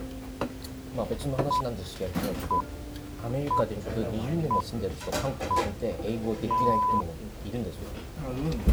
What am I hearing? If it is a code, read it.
Radio time signal (six pips, as the Greenwich Time Signal), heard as pips, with the noise of a restaurant.